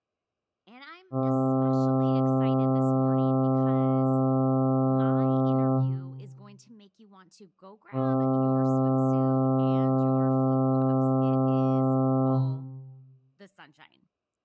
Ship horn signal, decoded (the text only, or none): 2 long